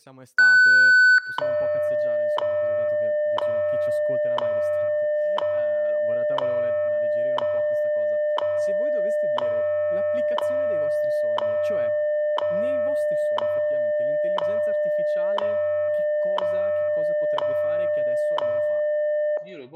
Radio time signal (WWV, Colorado), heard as ticks, one a second, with room echo and speech in Italian.